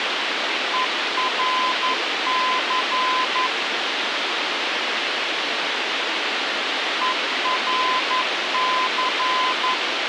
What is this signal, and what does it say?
Morse code, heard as a keyed tone, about 11 wpm, 1020 Hz, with radio hiss. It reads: ERC ERC